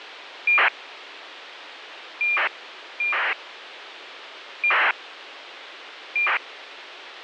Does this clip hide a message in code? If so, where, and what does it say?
Yes: ACARS aircraft data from 0.5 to 6.4 s, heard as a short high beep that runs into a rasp, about 2400 baud, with radio hiss.